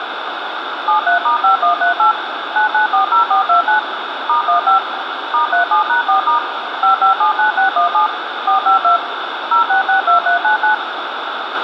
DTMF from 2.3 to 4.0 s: 9940429

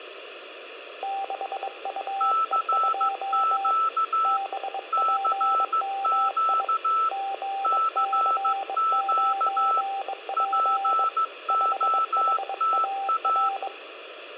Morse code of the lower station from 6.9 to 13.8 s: GC9P 5HAR

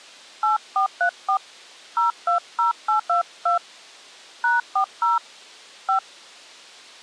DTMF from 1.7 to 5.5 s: 020822 #40

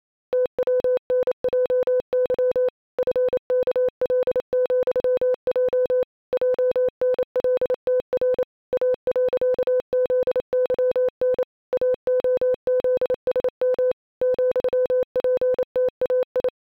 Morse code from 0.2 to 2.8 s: TWNJY

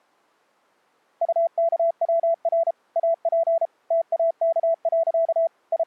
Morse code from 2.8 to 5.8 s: AP TAK. …

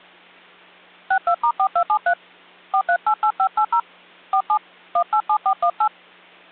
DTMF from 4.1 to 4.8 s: 47

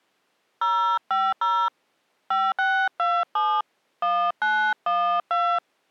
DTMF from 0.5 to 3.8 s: 050 5627

